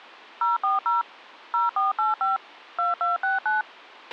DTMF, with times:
0.4-1.0 040
1.5-2.4 0485
2.8-3.6 2269

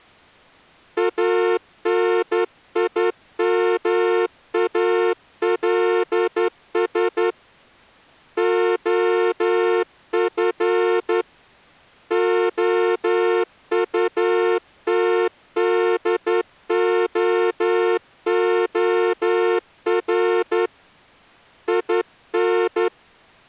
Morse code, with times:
1.0-7.3 ANIMALS
8.4-11.2 OF
12.1-20.7 OUTDOOR
21.7-22.9 IN

